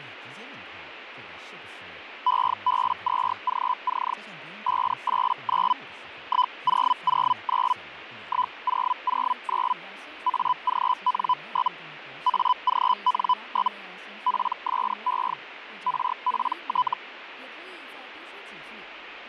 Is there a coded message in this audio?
Yes: Hellschreiber (Feld-Hell, 122.5 baud) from 2.3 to 16.9 s, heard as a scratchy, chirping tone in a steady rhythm, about 1000 Hz, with radio static and speech in Chinese. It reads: EB2GC 589 1009 1009 AGN? AGN? PSE RPT